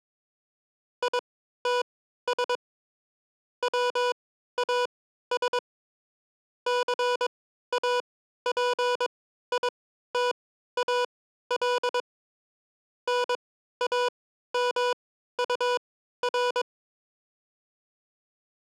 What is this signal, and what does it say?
Morse code, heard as electronic beeps, machine-sent, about 22 wpm, spaced as for 13 wpm, 490 Hz. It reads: ITS WAS CAPITAL NAMUR